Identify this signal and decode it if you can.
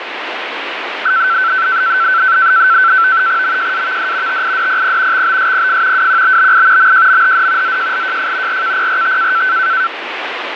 NAVTEX (SITOR-B), 100 baud, 170 Hz shift, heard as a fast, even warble, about 1430 Hz centre, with radio static. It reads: MJAVD TIDPP XBSPF WQBBI MJMHD ZJLJF RKPRT